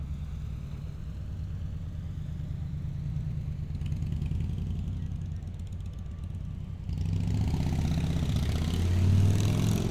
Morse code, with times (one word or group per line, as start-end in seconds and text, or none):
none